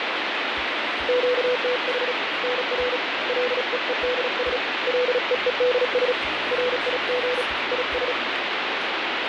Morse code, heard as a keyed tone, hand-sent with a paddle, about 36 wpm, 500 Hz, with heavy radio static and fading. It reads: QTH NR LEEDS LEEDS RIG IS